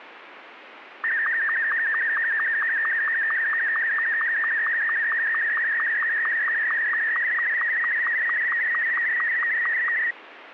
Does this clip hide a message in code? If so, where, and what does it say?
Yes: SSTV (slow-scan television), Martin M2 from 1.0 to 10.1 s, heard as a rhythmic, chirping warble, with radio static.